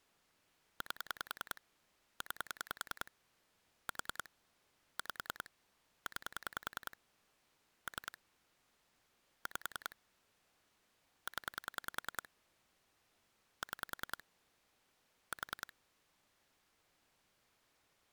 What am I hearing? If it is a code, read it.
Pulse dialling, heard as clicks on a phone line, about 10 pulses a second. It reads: 8 9 4 5 9 3 5 0 6 4